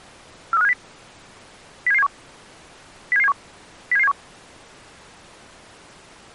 Five-tone selective call (EEA), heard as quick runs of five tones, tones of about 40 ms. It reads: 43570 07771 07771 07771